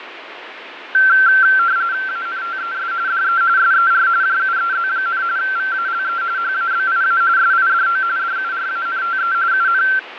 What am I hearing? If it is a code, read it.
RTTY (45.45 baud, 170 Hz shift), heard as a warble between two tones, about 1460 Hz centre, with radio static and fading. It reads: ANTES DE SER JUEZ, VALE HABIA SIDO DURANTE UN